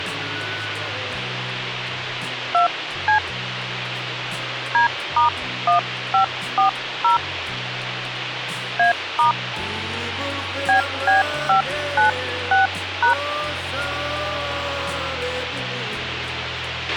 DTMF, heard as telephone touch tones, dialled by hand, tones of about 120 ms, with radio hiss and a squelch burst at the end. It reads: 2C D*1540 A* BB596#